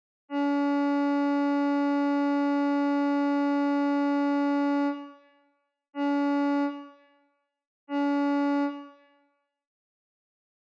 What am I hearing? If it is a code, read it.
Ship horn signal, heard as a ship's horn, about 280 Hz, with room echo. 1 long, 2 short. At sea: a vessel in fog that is sailing, fishing, towing or hampered.